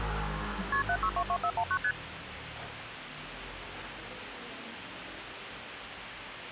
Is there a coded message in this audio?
Yes: multi-frequency trunk signalling (R1, as on North American trunks) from 0.7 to 1.9 s, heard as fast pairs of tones, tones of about 70 ms, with phone line noise and street noise. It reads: KP 7622419 ST